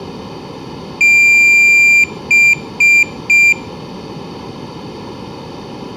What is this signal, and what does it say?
Beep code, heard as a piezo beeper, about 2400 Hz, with room echo. 1 long, 3 short. In Award and IBM BIOS tables: video adapter failure; in AMI BIOS tables: memory failure.